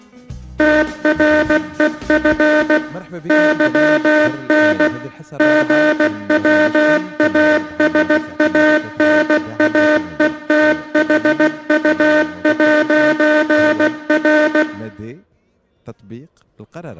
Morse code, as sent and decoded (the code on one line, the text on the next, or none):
- .-. . ..-. / -.-- -. / --. .-- .- ... .- -. .- . - .... ..- .----. .-.
TREF YN GWASANAETHU'R